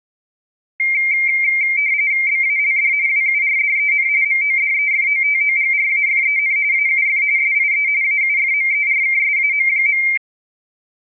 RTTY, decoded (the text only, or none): BALD WURDEN MODEFOTOGRAFEN AUF SIE AUFMERKSAM.